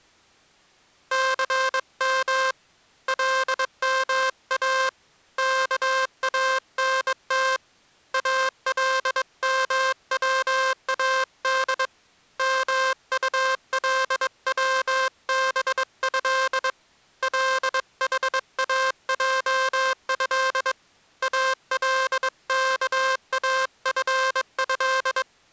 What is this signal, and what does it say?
Morse code (Arabic alphabet), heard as a buzzer, hand-sent with a bug key, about 22 wpm. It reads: ثم لما كانت المواد مطلوبه لحاجه الكافه